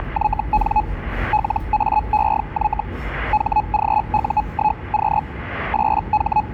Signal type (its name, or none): Hellschreiber